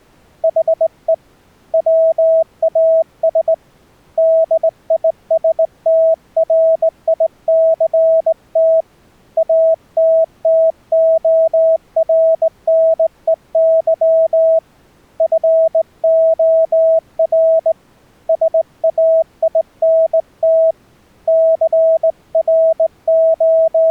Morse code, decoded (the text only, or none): HE WAS DISTRICT ATTORNEY FOR SAINT …